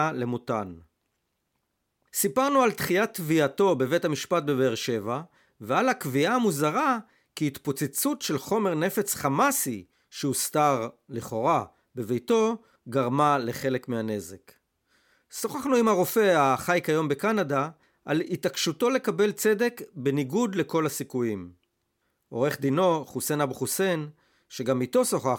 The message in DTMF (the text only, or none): none